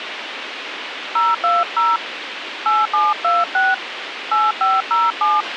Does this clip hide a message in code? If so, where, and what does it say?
Yes: DTMF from 1.2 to 5.4 s, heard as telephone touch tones, dialled by hand, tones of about 200 ms, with radio hiss and a squelch burst at the end. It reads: 020 8726 8507